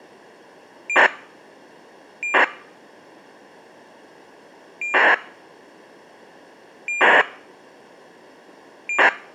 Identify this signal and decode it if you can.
ACARS aircraft data, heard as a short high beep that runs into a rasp, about 2400 baud.